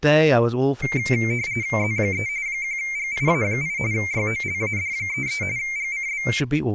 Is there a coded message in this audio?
Yes: RTTY (45.45 baud, 170 Hz shift) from 0.8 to 6.4 s, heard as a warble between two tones, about 2200 Hz centre, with speech in English. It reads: Z3 1GIA8 YOLAD33 GCB